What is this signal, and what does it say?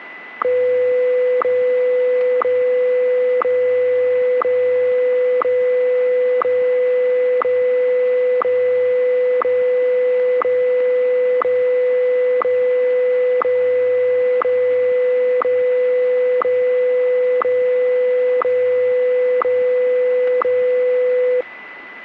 Radio time signal (WWVH, Hawaii), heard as ticks, one a second, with a steady whistle near 2000 Hz.